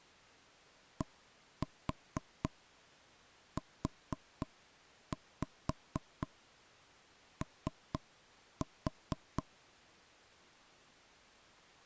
Tap code, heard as knocks on wood, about 4 knocks a second. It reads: DUO